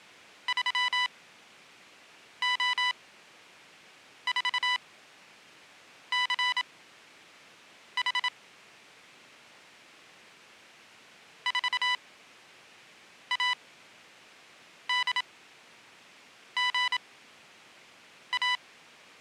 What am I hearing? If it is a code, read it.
Morse code, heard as electronic beeps, machine-sent, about 27 wpm, spaced as for 6 wpm, 990 Hz. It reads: 3O4CH 4ADGA